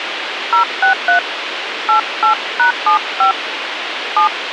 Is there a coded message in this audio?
Yes: DTMF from 0.5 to 4.3 s, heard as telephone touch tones, dialled by hand, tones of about 110 ms, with radio hiss. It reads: 063 88#75 7